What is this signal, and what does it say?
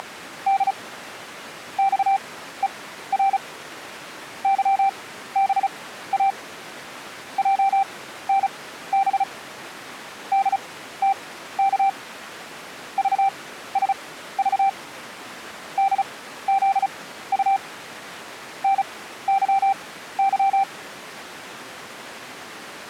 Morse code, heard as a keyed tone, machine-sent, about 35 wpm, spaced as for 15 wpm, 780 Hz. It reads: … XER YBA JNB DTK VSV DZU NYY